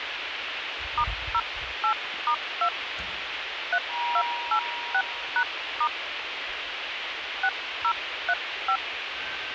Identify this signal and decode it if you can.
DTMF, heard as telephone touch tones, dialled by hand, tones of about 70 ms, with radio hiss and the noise inside a lift. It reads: *08*2 3286#* 6035